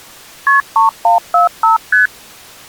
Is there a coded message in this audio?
Yes: multi-frequency trunk signalling (R1, as on North American trunks) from 0.5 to 2.1 s, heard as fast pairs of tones, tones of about 130 ms. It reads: KP 3145 ST